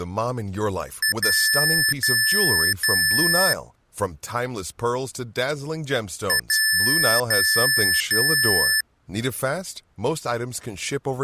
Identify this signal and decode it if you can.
Beep code, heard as beeps from a small speaker, played twice, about 1750 Hz, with speech in English. 1 short, 3 long.